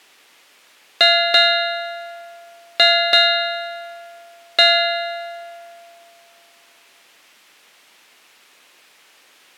Ship's bell, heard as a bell. 5. Five half-hours of the watch have passed.